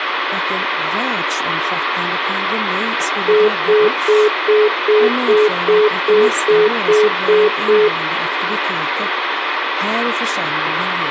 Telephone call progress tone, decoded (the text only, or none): congestion tone